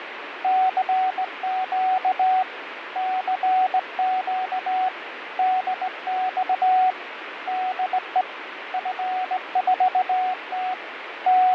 Morse code, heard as a keyed tone, hand-sent with a straight key, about 18 wpm, 740 Hz, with radio static and fading. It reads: CQ CQ DX DE F4T …